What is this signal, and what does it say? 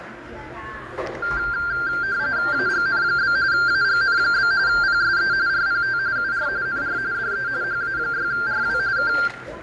RTTY (45.45 baud, 170 Hz shift), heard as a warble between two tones, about 1480 Hz centre, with radio static, fading, room echo and the noise of a cafe. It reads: AGN? AGN? PSE RPT UR NR DE HA6RW K